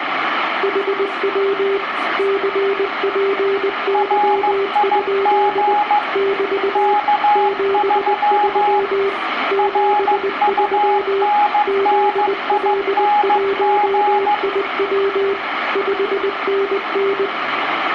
Morse code, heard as two keyed tones, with radio static, room echo and speech in English. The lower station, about 20 wpm, 390 Hz: HW CPY? <BT> 73 73 ZL1IW 5NN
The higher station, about 15 wpm, 830 Hz: RIG K3 RUNNING